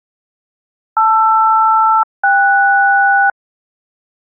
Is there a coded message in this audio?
Yes: aircraft SELCAL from 1.0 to 3.3 s, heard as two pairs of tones. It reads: LR-KS